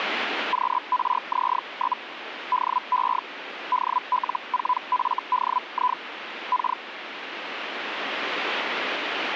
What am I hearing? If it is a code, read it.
Hellschreiber (Feld-Hell, 122.5 baud), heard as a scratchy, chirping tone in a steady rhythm, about 1000 Hz, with radio static. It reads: QRZ? DE DL4FDI K